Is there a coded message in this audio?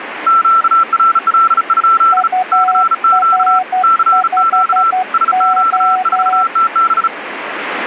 Yes: Morse code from 0.2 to 7.1 s, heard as two keyed tones, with radio static. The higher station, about 35 wpm, 1340 Hz: QRL? CQ CQ SQ4TB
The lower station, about 12 wpm, 740 Hz: UR5O